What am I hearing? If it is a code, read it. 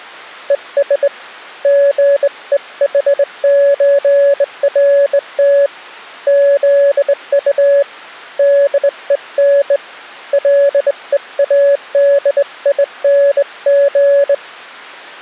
Morse code (with German letters), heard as a keyed tone, hand-sent with a straight key, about 20 wpm, 560 Hz. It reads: ES GEHÖRT ZU DEN LEADING